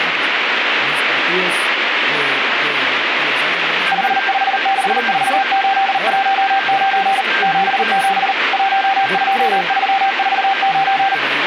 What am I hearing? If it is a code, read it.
Morse code, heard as a keyed tone, machine-sent, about 39 wpm, 780 Hz, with radio static, a weaker station near 1580 Hz and speech in Spanish. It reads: 5564819 77 12349